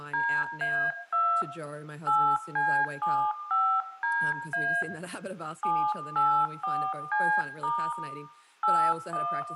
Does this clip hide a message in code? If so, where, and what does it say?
Yes: DTMF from 0.1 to 9.4 s, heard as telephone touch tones, dialled by hand, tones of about 290 ms, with room echo and speech in English. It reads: DA2 8C75DA 784C* 81